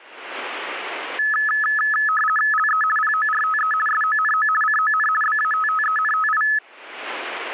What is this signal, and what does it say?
RTTY (50 baud, 450 Hz shift), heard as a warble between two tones, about 1500 Hz centre. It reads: LE PORTE SONO CON BATTENTI